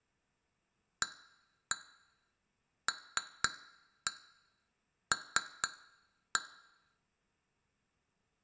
Tap code, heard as taps on glass, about 4 knocks a second. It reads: ALL